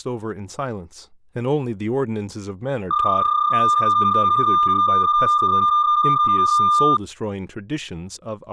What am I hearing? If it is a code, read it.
PSK31 (31.25 baud), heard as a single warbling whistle, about 1200 Hz, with speech in English.